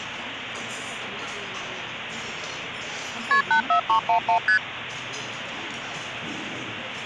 Multi-frequency trunk signalling (R1, as on North American trunks), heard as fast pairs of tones, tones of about 100 ms, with phone line noise and the noise of a crowd indoors. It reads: KP 84311 ST